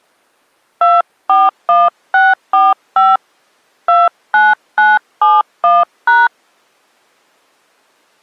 DTMF, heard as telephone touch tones, dialled by hand, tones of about 200 ms. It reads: 241645 29971#